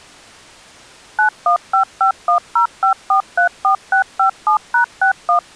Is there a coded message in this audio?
Yes: DTMF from 1.2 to 5.4 s, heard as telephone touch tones, dialled by machine, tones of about 100 ms. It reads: 9155105434657#61